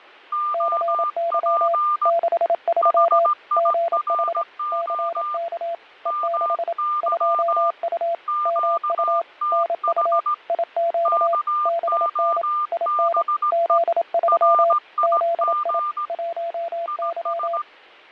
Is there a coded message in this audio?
Yes: Morse code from 0.3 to 17.7 s, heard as two keyed tones, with fading. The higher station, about 17 wpm, 1200 Hz: OP HIRO MY QTH KOBE RIG IS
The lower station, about 27 wpm, 680 Hz: CY 63 GH CK E6 2U MU NU IQ BN IN Z3 ZI 1Y